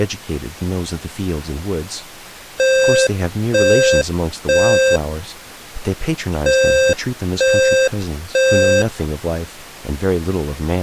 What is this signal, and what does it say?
Alarm pattern, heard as an alarm's beeps, played twice, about 530 Hz, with speech in English. Temporal three. Smoke or fire, evacuate.